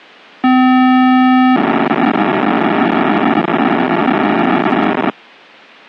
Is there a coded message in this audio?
Yes: POCSAG pager data (512 baud) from 0.4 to 5.1 s, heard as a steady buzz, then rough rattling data.